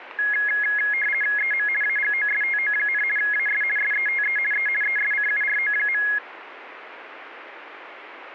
RTTY (50 baud, 450 Hz shift), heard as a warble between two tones, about 1900 Hz centre, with radio static. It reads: EM AGOSTO, AS SETE E ESCURO.